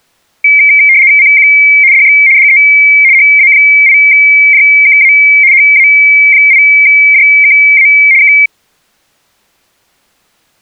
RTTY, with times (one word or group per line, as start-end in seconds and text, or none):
1.2-1.5 CQ
1.9-2.2 DX
2.4-2.6 DE
3.1-5.1 HA8JKA
5.5-7.9 HA8JKA
8.2-8.3 K